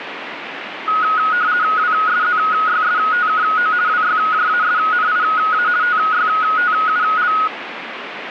RTTY (50 baud, 170 Hz shift), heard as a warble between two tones, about 1360 Hz centre, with radio static. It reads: WSZYSTKO WYJASNIA TYTUL